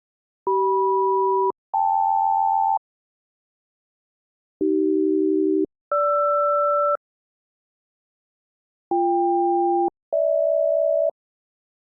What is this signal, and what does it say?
Aircraft SELCAL, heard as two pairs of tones. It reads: CM-KL AC-GR BK-GH